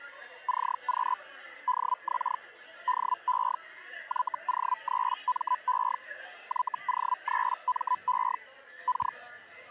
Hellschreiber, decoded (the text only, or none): CQ DX DE YO3ME YO3ME K